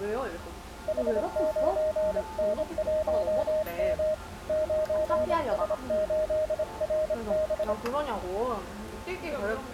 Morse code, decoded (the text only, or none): H9N1M 9S8RB